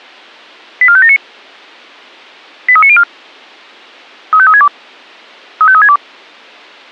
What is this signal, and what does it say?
Five-tone selective call (ZVEI), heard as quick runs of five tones, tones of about 70 ms. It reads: 84579 83904 35362 35362